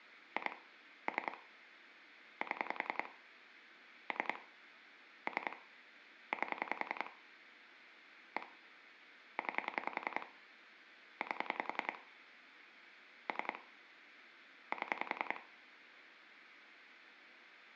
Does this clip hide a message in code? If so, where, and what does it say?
Yes: pulse dialling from 0.4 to 15.4 s, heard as clicks on a phone line, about 10 pulses a second, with room echo. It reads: 2 3 7 3 3 8 1 9 8 3 7